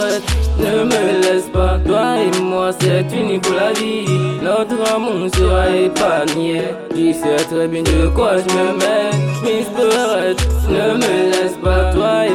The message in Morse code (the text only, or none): none